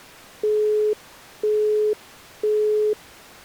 Telephone call progress tone (single-tone plan, as in Europe, Japan and elsewhere), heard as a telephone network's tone, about 420 Hz, 0.5 s on and 0.5 s off. Busy tone.